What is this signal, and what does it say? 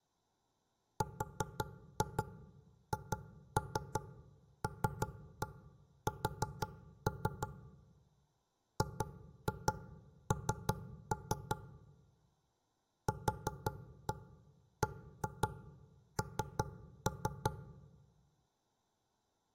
Tap code, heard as knocks on wood, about 5 knocks a second. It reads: RHLS GN QBN